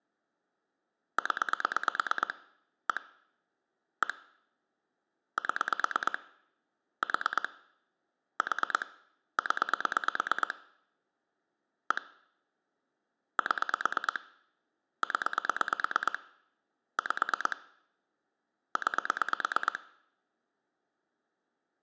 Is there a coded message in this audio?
Yes: pulse dialling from 1.2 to 19.8 s, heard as clicks on a phone line, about 9 pulses a second. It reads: 0 1 1 7 4 4 0 1 7 0 5 9